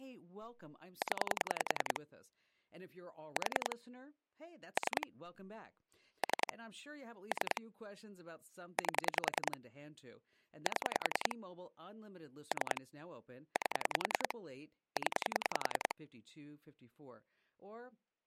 Pulse dialling, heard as clicks on a phone line, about 10 pulses a second, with speech in English. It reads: 0 4 3 3 3 8 7 3 8 0